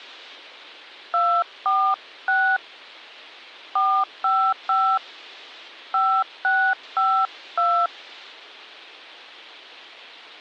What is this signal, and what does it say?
DTMF, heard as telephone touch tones, dialled by hand, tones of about 280 ms. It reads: 246 455 5652